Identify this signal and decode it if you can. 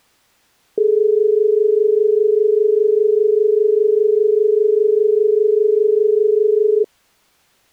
Telephone call progress tone (as in Australia), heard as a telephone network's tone, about 430 Hz. Dial tone.